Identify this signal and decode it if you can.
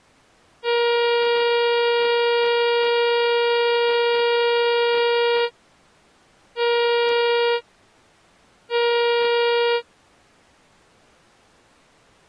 Ship horn signal, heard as a ship's horn, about 470 Hz. 1 long, 2 short. At sea: a vessel in fog that is sailing, fishing, towing or hampered.